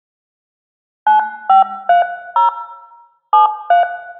DTMF, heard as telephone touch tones, dialled by hand, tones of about 130 ms, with room echo. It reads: 9530 73